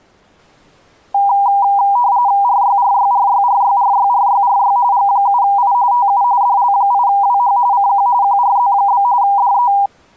RTTY (45.45 baud, 170 Hz shift), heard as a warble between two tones, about 880 Hz centre. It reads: RYRYRYRYRYRYRY G7I TU DL8WH CQ QRZ? DE